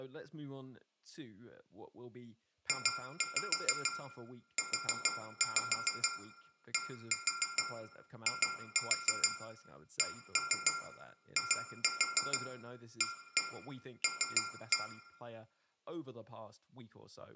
Tap code, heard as taps on glass, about 6 knocks a second, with room echo and speech in English. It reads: JUDICIAL